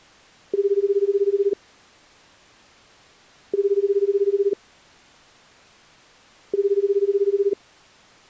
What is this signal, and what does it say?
Telephone call progress tone (Japanese plan), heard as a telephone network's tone, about 380, 400, 420 Hz, 1 s on and 2 s off. Ringback tone.